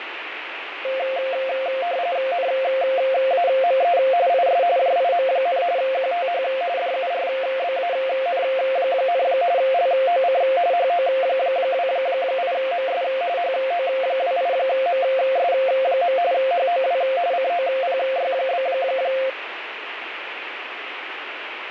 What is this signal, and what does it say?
RTTY (45.45 baud, 170 Hz shift), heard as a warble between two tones, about 610 Hz centre, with radio static. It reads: NAME IS JIM, QTH DURBAN, LOC HO28MS HO28MS. HOW COPY?